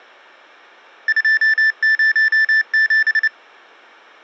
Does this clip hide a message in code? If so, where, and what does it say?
Yes: Morse code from 1.0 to 3.3 s, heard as electronic beeps, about 29 wpm, 1750 Hz. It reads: 207